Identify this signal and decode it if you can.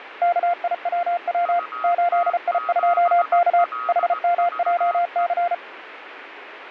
Morse code, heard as two keyed tones, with radio static. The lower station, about 34 wpm, 700 Hz: KIWW 8I2K HMJC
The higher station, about 18 wpm, 1260 Hz: UT7LVE